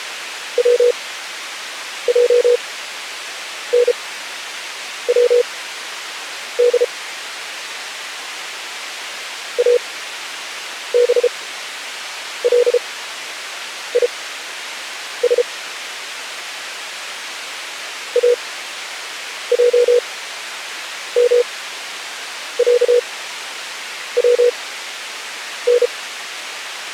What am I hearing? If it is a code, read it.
Morse code (Arabic alphabet), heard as a keyed tone, machine-sent, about 33 wpm, spaced as for 7 wpm, 480 Hz. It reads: وجنود ابليس اجمعون